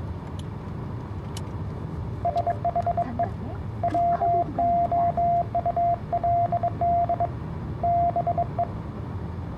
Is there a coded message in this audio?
Yes: Morse code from 2.2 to 8.7 s, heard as a keyed tone, hand-sent with a bug key, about 22 wpm, 690 Hz, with the noise inside a car. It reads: SHE WOULD BE